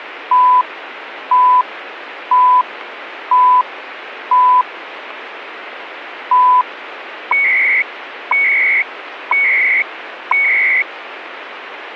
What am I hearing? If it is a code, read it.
Radio time signal (CHU, Canada), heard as beeps and data bursts, one a second, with radio static.